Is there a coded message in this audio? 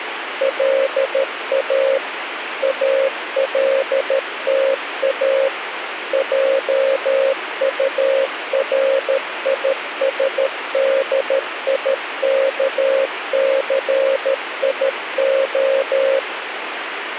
Yes: Morse code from 0.3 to 16.3 s, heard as a keyed tone, machine-sent, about 13 wpm, 540 Hz, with radio static. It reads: LA ALTA JURISDIKCIO